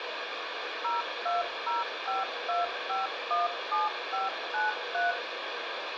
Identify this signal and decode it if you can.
DTMF, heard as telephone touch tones, dialled by machine, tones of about 160 ms, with phone line noise and room echo. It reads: 02052517593